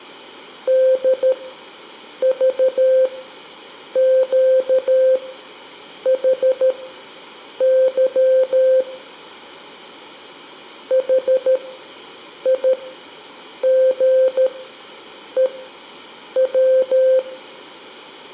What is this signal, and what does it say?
Morse code, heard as a keyed tone, machine-sent, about 13 wpm, spaced as for 7 wpm, 520 Hz, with room echo. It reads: DVQHY HIGEW